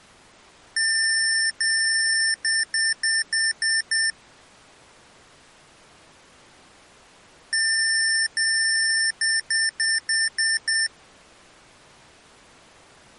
Beep code, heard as beeps from a small speaker, played twice, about 1800 Hz. 2 long, 6 short.